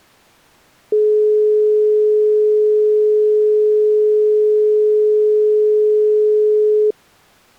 Telephone call progress tone (425 Hz plan, as in most of Europe), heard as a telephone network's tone, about 420 Hz. Dial tone.